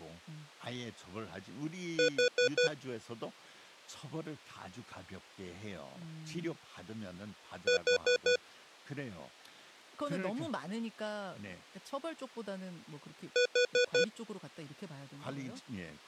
Alarm pattern, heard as an alarm's beeps, played three times, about 490 Hz, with speech in Korean. Temporal four. Carbon monoxide.